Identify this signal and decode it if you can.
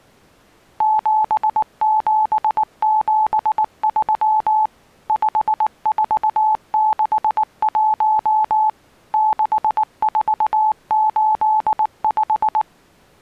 Morse code, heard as a keyed tone, machine-sent, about 19 wpm, 860 Hz. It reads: 7773 5461 6485